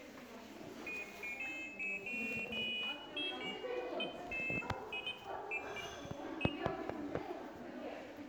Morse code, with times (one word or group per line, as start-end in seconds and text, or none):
none